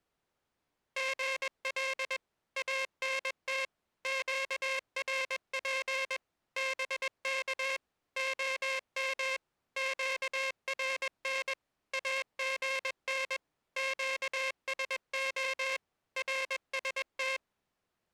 Morse code, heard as a buzzer, machine-sent, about 21 wpm. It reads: GL ANT QRP BK OM QRN AGN QSO RST